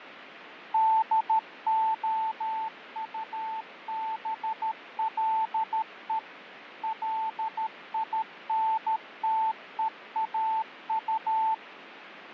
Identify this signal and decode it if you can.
Morse code, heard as a keyed tone, machine-sent, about 13 wpm, 880 Hz, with radio static and fading. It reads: DOUBLE LINTEAU